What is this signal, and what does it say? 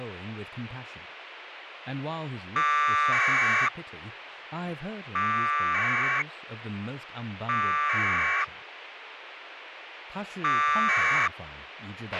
Packet radio (AX.25, as in APRS), 1200 baud, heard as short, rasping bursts, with radio hiss, a squelch burst at the end and speech in Chinese.